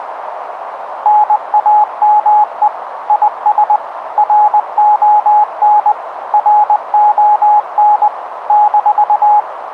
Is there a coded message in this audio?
Yes: Morse code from 1.0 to 9.5 s, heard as a keyed tone, machine-sent, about 20 wpm, 840 Hz, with radio static and a narrow filter. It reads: NAME IS RON RON -